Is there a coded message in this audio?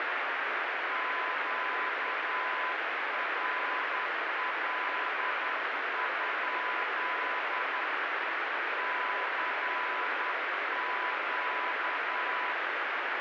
Yes: Morse code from 0.8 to 12.6 s, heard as a keyed tone, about 10 wpm, 1000 Hz, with heavy radio static. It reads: QRL? CQ